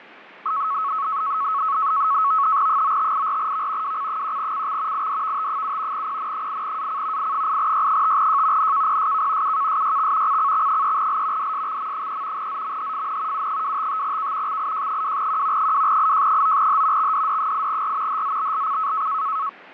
NAVTEX (SITOR-B), 100 baud, 170 Hz shift, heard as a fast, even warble, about 1200 Hz centre, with radio static and fading. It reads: 9584V WC1CX IDVT7 PN8AC I8Y5J NKPSK UKSYX CCX3L DSXM3 ZMHFN U255K XIJ2Q 2IJ9H XDD8R HZBLC